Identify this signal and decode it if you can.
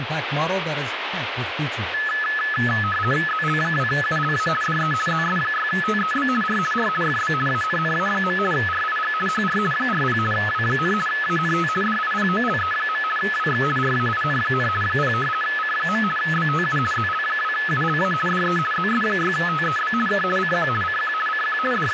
RTTY (50 baud, 450 Hz shift), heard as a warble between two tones, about 1500 Hz centre, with radio static and speech in English. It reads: ZL2ULA DE ZS6TEB R R FB ANNA. RIG HR 40 W, ANT DIPOLE. WX RAIN, 0 C. BTU ZL2ULA DE ZS6TEB K CQ CQ CQ …